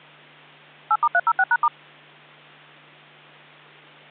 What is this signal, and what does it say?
DTMF, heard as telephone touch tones, dialled by machine, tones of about 50 ms, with hum. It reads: 8*306#*